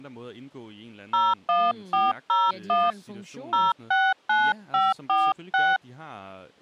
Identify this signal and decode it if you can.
DTMF, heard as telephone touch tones, dialled by hand, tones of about 200 ms, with speech in Danish. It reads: 01401 069546